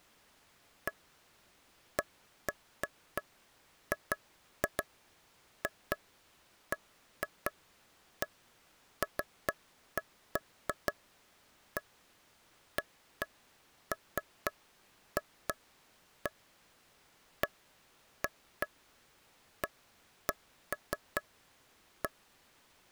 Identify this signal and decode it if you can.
Irregular taps on a table. There is no code.